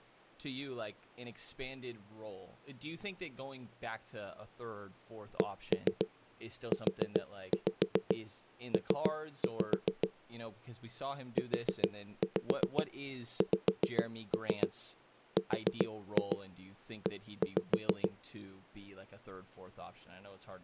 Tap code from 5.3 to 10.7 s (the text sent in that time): CUP